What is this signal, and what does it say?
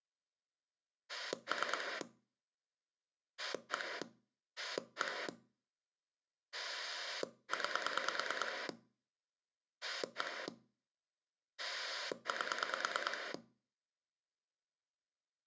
Pulse dialling, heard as a rotary dial, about 9 pulses a second. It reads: 3 1 1 9 1 8